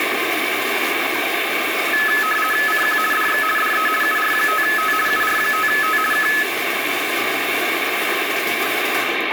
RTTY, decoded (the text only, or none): CQ DX DE UR5T UR5T K